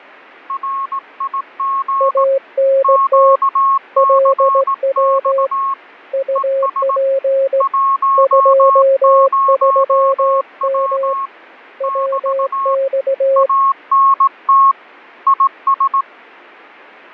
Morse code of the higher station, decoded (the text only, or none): RIG QCX ES 10W <BT> ANT IS